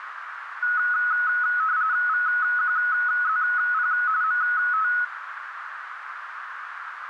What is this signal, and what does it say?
RTTY (45.45 baud, 170 Hz shift), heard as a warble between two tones, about 1370 Hz centre, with radio static and a narrow filter. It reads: VQZP MT